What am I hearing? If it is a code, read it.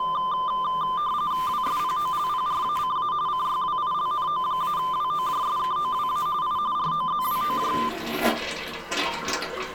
RTTY (45.45 baud, 170 Hz shift), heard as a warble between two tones, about 1110 Hz centre, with the noise of a restroom. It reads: WSPOLPRACA CYWILNO-WOJSKOWA I ROZWOJ